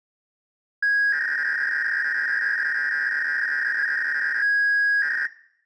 300-baud modem data (V.21 tones), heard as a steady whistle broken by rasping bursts, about 300 baud, 200 Hz shift.